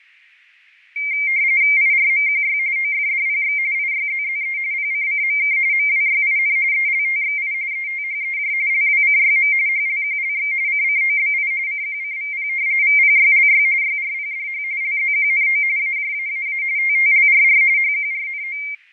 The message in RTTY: IRMQY OFDPX IYZZE PCCMK MWYIN ELTXI ETHEJ LWCYM HLQLX CCOBI CQCVP VPYLY YRPDH LZQNO AJAAA TTLRR HQRNO

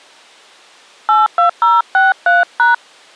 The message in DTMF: 82063#

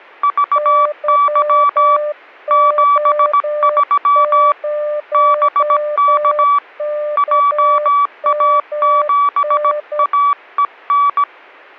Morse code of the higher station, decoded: VY 73 BK JA7AEN

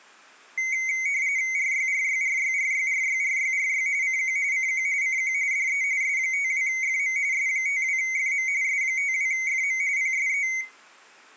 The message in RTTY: RYRYRYRYRYRYRY CQ CQ CQ DE S52FM S52FM S52FM PSE

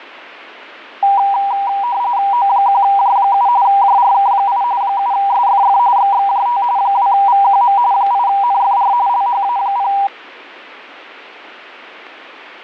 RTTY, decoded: O1J7 JRK8 7SFF XXJT 2VQM 8NFR LHA0

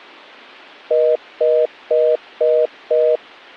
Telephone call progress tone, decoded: congestion tone

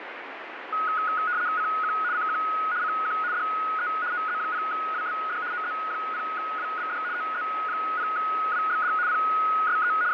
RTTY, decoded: CQ CQ CQ DE OZ0WBD OZ0WBD OZ0WBD PSE …

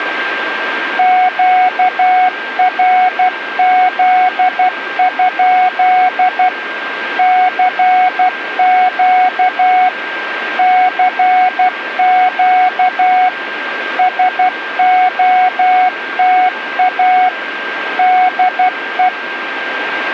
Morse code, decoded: QRZ? CQ CQ SOTA DE

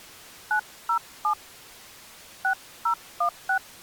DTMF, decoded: 907 6016

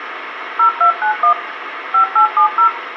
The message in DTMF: 0291 5870

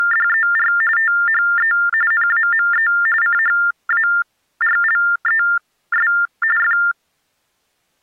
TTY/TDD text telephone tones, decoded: … THE NAME CHARLES F

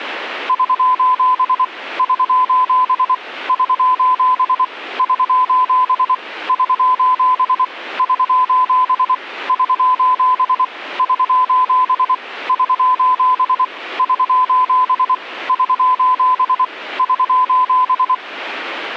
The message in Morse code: <SOS> <SOS> <SOS> <SOS> <SOS> <SOS> <SOS> <SOS> <SOS> <SOS> <SOS> <SOS>

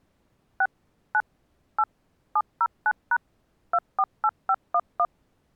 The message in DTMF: 6 9 8 709# 248511

